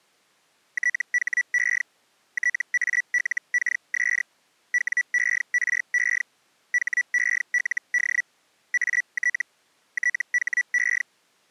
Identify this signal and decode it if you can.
Hellschreiber (Feld-Hell, 122.5 baud), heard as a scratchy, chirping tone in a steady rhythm, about 1950 Hz. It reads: THE TALKS WERE HELD AT THE